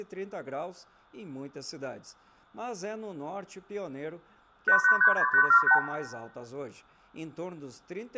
Multi-frequency trunk signalling (R2, with the far end's replies), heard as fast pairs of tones, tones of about 80 ms, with room echo. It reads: 8836878